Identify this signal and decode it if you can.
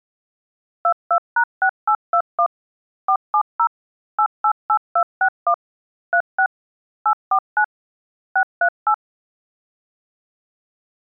DTMF, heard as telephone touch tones, dialled by machine, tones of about 80 ms. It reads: 22#6821 470 888261 36 849 638